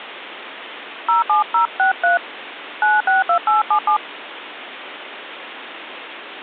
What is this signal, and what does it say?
DTMF, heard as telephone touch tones, dialled by hand, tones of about 140 ms, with phone line noise. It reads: 07063 962877